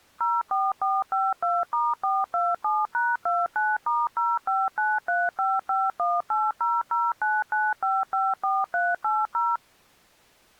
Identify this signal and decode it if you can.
DTMF, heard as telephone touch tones, dialled by machine, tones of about 210 ms. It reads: 04452*427#29*059355180099554380